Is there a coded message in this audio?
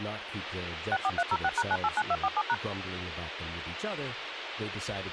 Yes: DTMF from 0.9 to 2.5 s, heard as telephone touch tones, dialled by machine, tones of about 50 ms, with radio hiss and speech in English. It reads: 64306#989247#